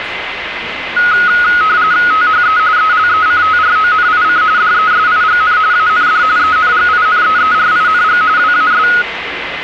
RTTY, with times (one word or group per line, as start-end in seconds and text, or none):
2.1-2.6 THE
2.8-4.4 ELECTRONIC
4.6-5.6 DESIGN
5.7-6.2 AND
6.4-8.2 ENGINEERING
8.4-8.9 WAS